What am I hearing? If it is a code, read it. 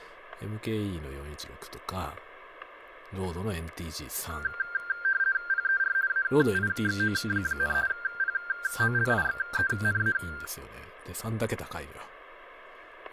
RTTY (50 baud, 170 Hz shift), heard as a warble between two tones, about 1490 Hz centre, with static crashes and speech in Japanese. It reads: PER AIXO, POLIXENA